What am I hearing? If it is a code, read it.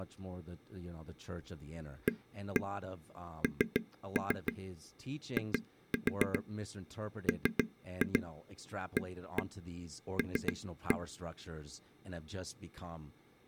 Tap code, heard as taps on a table, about 6 knocks a second, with speech in English. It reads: ANIMAL